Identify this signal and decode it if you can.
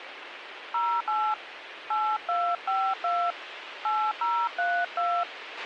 DTMF, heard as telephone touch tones, dialled by hand, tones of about 260 ms, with radio hiss and a squelch burst at the end. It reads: 08 8252 8032